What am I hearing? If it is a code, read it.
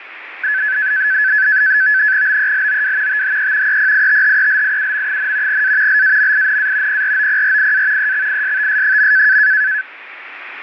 NAVTEX (SITOR-B), 100 baud, 170 Hz shift, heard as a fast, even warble, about 1600 Hz centre, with radio static. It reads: BELOW THE EPITHELIUM, A LAMINA PROPRIA EXISTS.